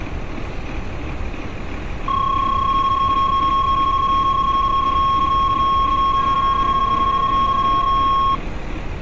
PSK31 (31.25 baud), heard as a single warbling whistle, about 1090 Hz, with street noise.